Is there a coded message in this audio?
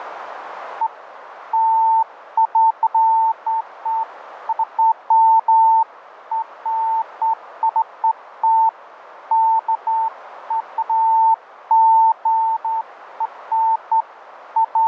No, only beeps of irregular length, with radio static.